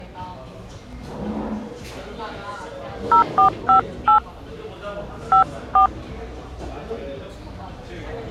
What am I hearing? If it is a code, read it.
DTMF, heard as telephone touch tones, dialled by hand, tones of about 110 ms, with the noise of a cafe. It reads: 0458 54